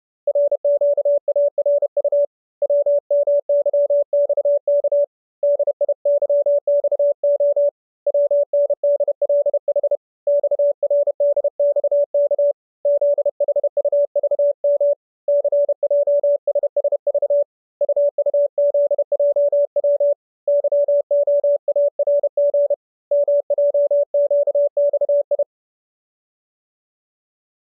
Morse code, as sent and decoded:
.-. --.- .- .-. ..- / .-- -- -.-- -..- -.- / -.. .. -.-- -..- --- / .-- -. -.. .-.. .... / -..- .-. -.. -..- -.- / --.. .... ..- ...- -- / -.-. .--- ... ... ...- / ..- ..- --.. .--- .-- / -.-- --- .- .-. --. / -- .--- --.- -..- ..
RQARU WMYXK DIYXO WNDLH XRDXK ZHUVM CJSSV UUZJW YOARG MJQXI

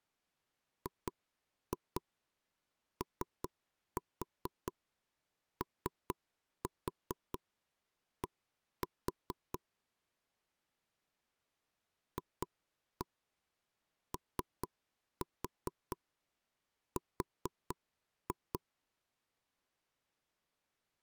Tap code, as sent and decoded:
2-2 3-4 3-4 1-4 / 2-1 3-4 4-2
GOOD FOR

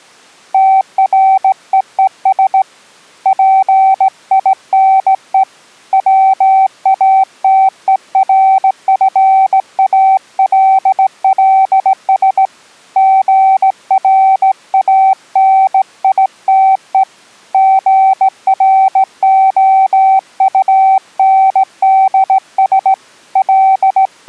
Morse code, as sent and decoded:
- .-. . . ... / .--. .. -. . / .-- .- - . .-. ..-. .- .-.. .-.. ... / --. .-. .- -. .. - . / --. .-. --- ..- -. -.. ... / …
TREES PINE WATERFALLS GRANITE GROUNDS …

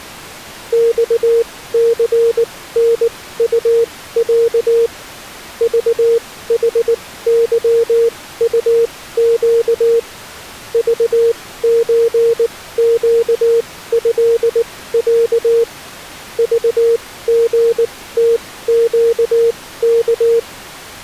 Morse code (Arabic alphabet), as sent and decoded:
-..- -.-. -. ..- .-.- / ...- .... -.-- ..- --.- / ...- ---. --.- ..-.. .-.- / ...- --. - --.- -.-
صثنطع ضحظطق ضزقهع ضغتقك

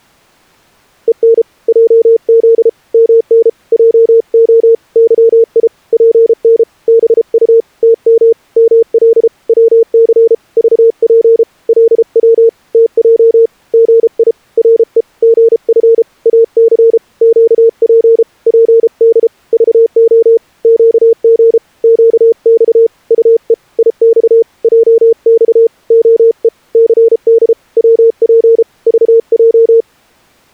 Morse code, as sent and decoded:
. -. / .--- --.. / -- -. / .--- --- / -.-- .. / .--. -. / -... ..- / - -- / -- .-.. / .-- -.-. / ...- .--. / .-.. .-- / - .--- / --. .. / .-. . / --. ..-. / .- -.-. / --.- .--. / .--. -.. / ...- --- / --.- --. / --.- -..- / ..- . / .. -..- / .--- -..- / --- . / -.-. -.. / .-- .--. / ...- .---
EN JZ MN JO YI PN BU TM ML WC VP LW TJ GI RE GF AC QP PD VO QG QX UE IX JX OE CD WP VJ

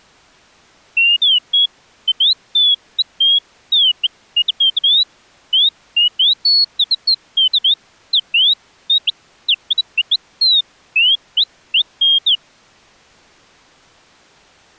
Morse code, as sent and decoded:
none

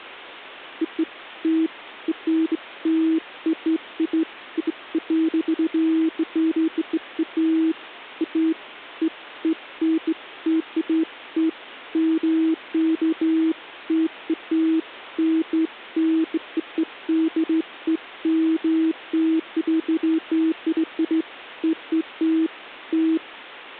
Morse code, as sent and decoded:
none

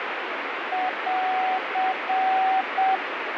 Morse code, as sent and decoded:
.-.-.
<AR>

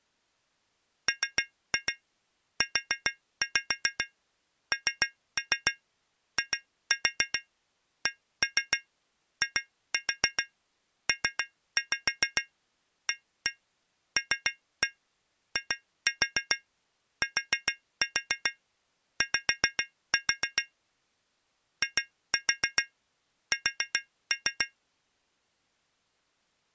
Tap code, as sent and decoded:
3-2 4-5 3-3 2-4 1-3 2-4 3-5 1-1 3-1 2-4 4-4 5-4 / 2-4 4-3
MUNICIPALITY IS

